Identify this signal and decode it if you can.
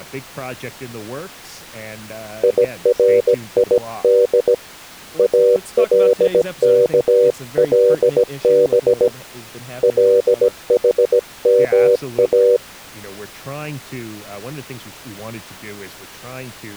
Morse code (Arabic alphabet), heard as a keyed tone, hand-sent with a bug key, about 17 wpm, 490 Hz, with speech in English. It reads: يريد الكلب لحما